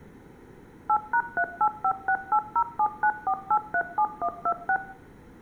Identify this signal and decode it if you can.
DTMF, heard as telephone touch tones, dialled by machine, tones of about 70 ms, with room echo. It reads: 8#385680794837126